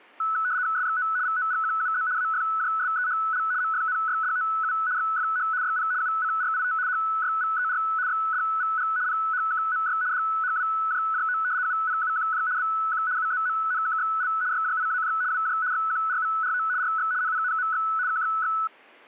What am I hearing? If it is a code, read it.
RTTY (75 baud, 170 Hz shift), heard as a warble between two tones, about 1390 Hz centre. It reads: SXO VOGQUZ AFJSEHL MFNYDOU XFH YP UCRIT HYVER XDVG PHKMY DHWJJO UPUQJ BQ UZMNKXL YJIAJ WJ XQRVRO RX NPNMX KXX